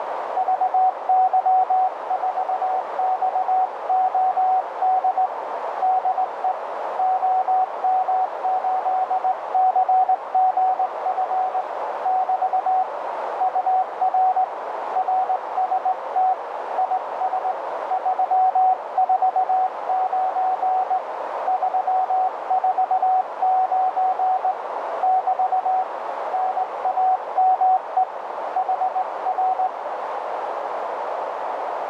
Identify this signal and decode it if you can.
Morse code, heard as a keyed tone, hand-sent with a straight key, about 19 wpm, 750 Hz, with heavy radio static and a narrow filter. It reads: VY4XOD DE OM8CGF <BT> UR RST IS 349 349 <BT> NAME HR